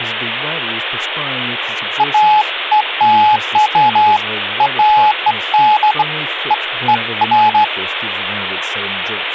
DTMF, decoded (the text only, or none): none